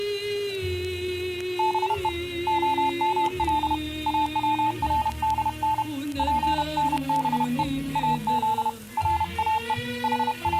Morse code (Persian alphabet), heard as a keyed tone, hand-sent with a paddle, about 31 wpm, 880 Hz. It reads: به عمل اوردن پنبه از راه …